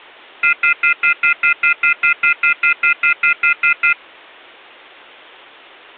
Telephone call progress tone (North American plan), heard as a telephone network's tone, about 1400, 2050, 2450, 2600 Hz, 0.1 s on and 0.1 s off. Off-hook warning tone.